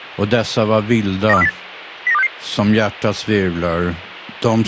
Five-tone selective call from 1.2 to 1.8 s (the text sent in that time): 92408